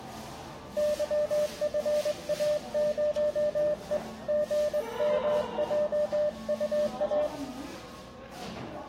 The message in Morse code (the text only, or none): YFA0E GMJUA